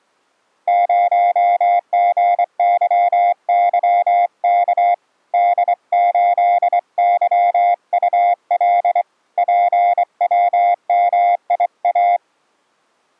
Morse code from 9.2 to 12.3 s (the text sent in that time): PWMIA